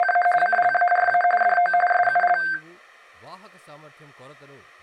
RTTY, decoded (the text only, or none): … CLARA DO SUL